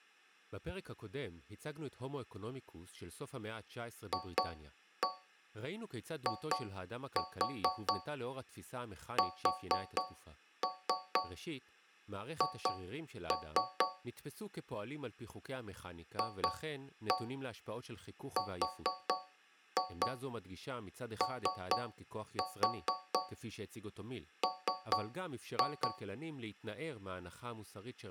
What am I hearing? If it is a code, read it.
Tap code, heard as taps on a metal pipe, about 4 knocks a second, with speech in Hebrew. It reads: FISH FROM